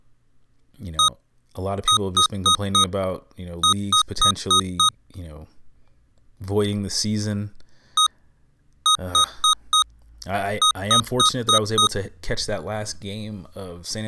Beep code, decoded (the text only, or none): 1-4-5